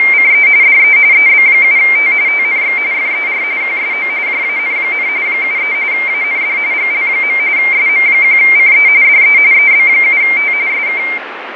RTTY (45.45 baud, 170 Hz shift), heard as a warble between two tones, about 2200 Hz centre, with radio static and fading. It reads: … DE EB7T TNX FER QSO JAN, 73 AND GL. SM1CE DE EB7T SK